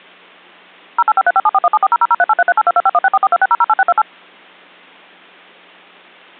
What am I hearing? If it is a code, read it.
DTMF, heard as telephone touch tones, dialled by machine, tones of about 40 ms. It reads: 085357417400038338225164426008628